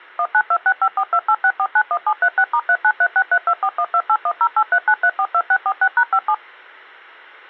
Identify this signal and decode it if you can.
DTMF, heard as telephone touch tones, dialled by machine, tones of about 60 ms. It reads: 192654286491736*393632412810839342646#57